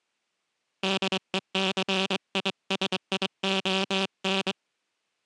Morse code, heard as a buzzer, hand-sent with a straight key, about 23 wpm. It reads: DECISION